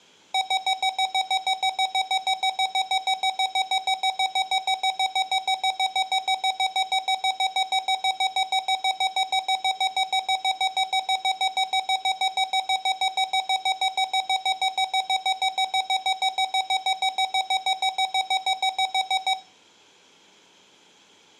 Evenly repeated beeps, with room echo. There is no code.